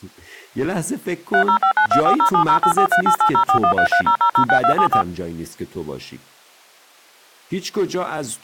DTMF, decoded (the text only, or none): 30592407084388041330006274